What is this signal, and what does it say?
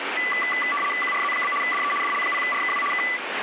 RTTY (75 baud, 850 Hz shift), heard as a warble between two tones, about 1600 Hz centre, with radio static. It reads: QRZ? DE DL0RKW K